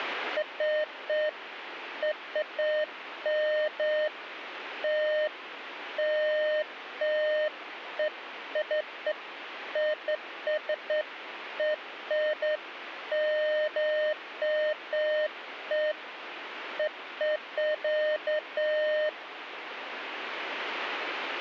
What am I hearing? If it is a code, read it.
Beeps of irregular length, with radio static. There is no code.